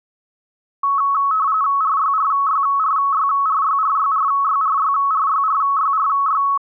RTTY (45.45 baud, 170 Hz shift), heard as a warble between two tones, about 1200 Hz centre. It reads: RYRYRYRYRYRYRYRYRYRY